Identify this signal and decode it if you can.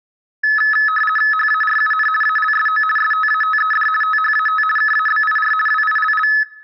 RTTY (50 baud, 450 Hz shift), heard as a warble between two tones, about 1500 Hz centre. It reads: HARUN ALSO STATED THAT KABIR WILL